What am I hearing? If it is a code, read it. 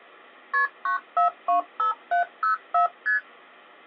Multi-frequency trunk signalling (R1, as on North American trunks), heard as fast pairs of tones, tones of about 120 ms. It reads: KP 9425704 ST